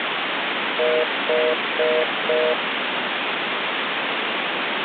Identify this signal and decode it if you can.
Telephone call progress tone (North American plan), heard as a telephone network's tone, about 480, 620 Hz, 0.25 s on and 0.25 s off, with phone line noise. Congestion tone.